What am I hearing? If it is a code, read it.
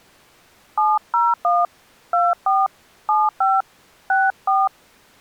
DTMF, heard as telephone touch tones, dialled by hand, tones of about 200 ms. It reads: 701 24 75 64